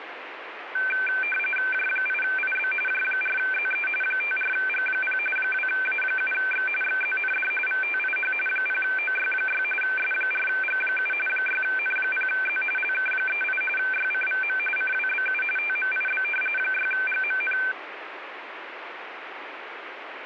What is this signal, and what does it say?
RTTY (45.45 baud, 850 Hz shift), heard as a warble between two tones, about 1950 Hz centre, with radio static. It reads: J8IB J4ZE 54G0 2A7X XZND VTIH 0OY6 S4G7 6N0Z LK38 YCVM CWBU TMIB 6GMN